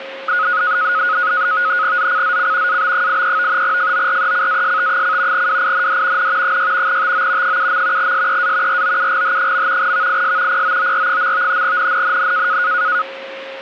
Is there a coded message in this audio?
Yes: NAVTEX (SITOR-B), 100 baud, 170 Hz shift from 0.3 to 13.0 s, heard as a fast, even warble, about 1360 Hz centre, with radio static and a steady whistle near 540 Hz. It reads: ZCZC AB83 FORECAST: WIND N 6 TO 7. SEA ROUGH. VIS POOR. NNNN